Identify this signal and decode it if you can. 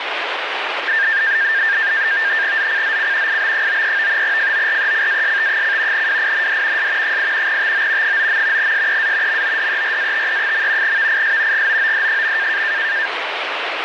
NAVTEX (SITOR-B), 100 baud, 170 Hz shift, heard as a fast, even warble, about 1700 Hz centre, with radio static. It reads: ZCZC IB93 FORECAST: WIND S 8 TO 9. SEA MODERATE. VIS GOOD.